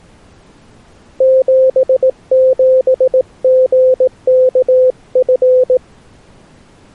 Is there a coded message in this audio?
Yes: Morse code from 1.1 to 5.8 s, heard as a keyed tone, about 18 wpm, 520 Hz. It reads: 77GKF